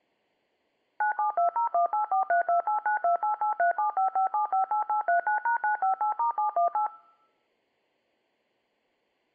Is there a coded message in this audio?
Yes: DTMF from 1.0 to 6.9 s, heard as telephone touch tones, dialled by machine, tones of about 120 ms. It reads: 972018432892883755758839#958*718